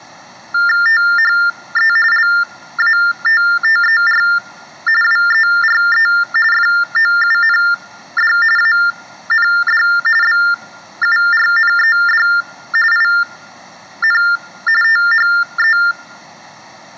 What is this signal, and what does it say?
TTY/TDD text telephone tones (45.45 baud Baudot), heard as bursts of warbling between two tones, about 400 Hz shift, 1600 Hz centre. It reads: THE LATTER WERE FOUND AND BURNED IN THE